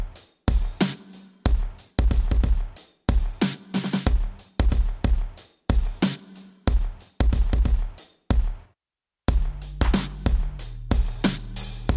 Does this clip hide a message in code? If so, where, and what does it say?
No.